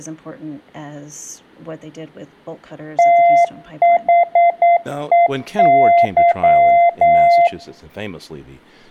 Morse code, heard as a keyed tone, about 9 wpm, 690 Hz, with speech in English. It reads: THEY